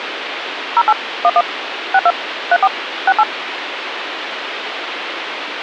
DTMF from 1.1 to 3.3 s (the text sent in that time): 11 62 34 68